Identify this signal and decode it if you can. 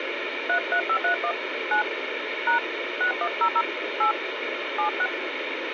DTMF, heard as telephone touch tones, dialled by hand, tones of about 90 ms, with radio hiss. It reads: 33531 9 # 6100 8 76